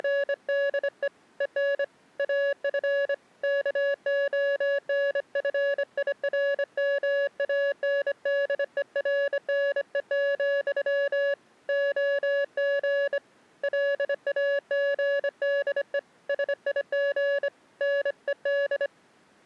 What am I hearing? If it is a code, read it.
Morse code, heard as a keyed tone, hand-sent with a bug key, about 25 wpm, 560 Hz. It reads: … EN AF KONFIRMANDERNE, OG LAGDE SIG NED